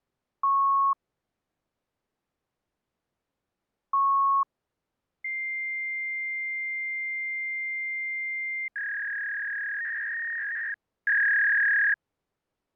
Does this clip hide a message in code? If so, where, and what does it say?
Yes: fax machine handshake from 0.4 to 11.9 s, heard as beeps, a long tone and a warble.